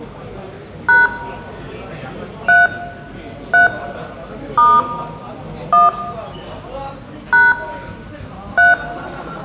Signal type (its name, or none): DTMF